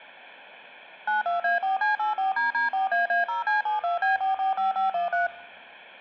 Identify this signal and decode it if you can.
DTMF, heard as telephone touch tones, dialled by machine, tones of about 140 ms. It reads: 92A4C84DD4AA0C72B445513